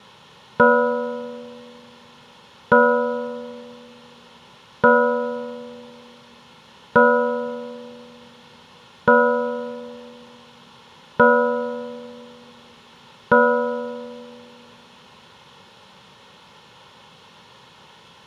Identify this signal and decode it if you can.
Clock strike, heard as a bell, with room echo. 7. Seven o'clock.